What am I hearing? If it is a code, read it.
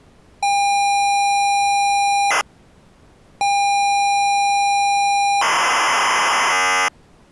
ZX Spectrum tape loading, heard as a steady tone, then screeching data.